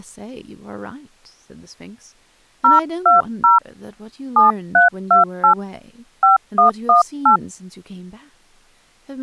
DTMF, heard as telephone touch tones, dialled by hand, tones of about 130 ms, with speech in English. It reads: 020 7328 5118